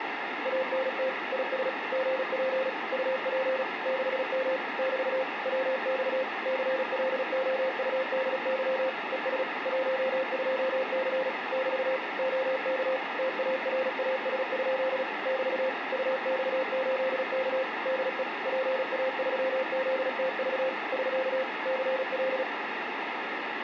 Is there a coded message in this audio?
Yes: Morse code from 0.4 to 22.5 s, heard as a keyed tone, machine-sent, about 36 wpm, 520 Hz, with radio static and room echo. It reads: ANT IS GP UP 6M <BT> WX CLOUDY ES 12C <BT> OK TARAS? <BT> UX8K DE PA3ZTV <SK> CL